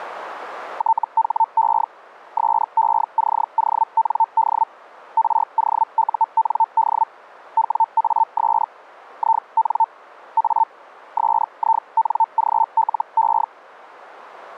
Hellschreiber (Feld-Hell, 122.5 baud), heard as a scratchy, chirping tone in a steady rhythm, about 900 Hz. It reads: THE SECOND ROUND WAS IN A SINGLE